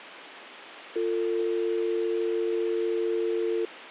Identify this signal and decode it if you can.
Telephone call progress tone (North American or UK plan), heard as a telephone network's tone, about 350, 450 Hz. Dial tone.